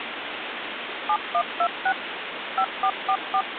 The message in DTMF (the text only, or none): 7126 5444